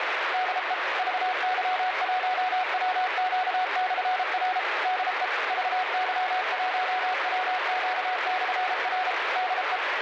Morse code, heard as a keyed tone, machine-sent, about 33 wpm, 740 Hz, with heavy radio static. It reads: DE VY1WQ/R DE VY1WQ/R DE